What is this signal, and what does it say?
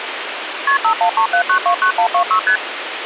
Multi-frequency trunk signalling (R1, as on North American trunks), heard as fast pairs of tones, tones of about 90 ms, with phone line noise. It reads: KP 5137929126 ST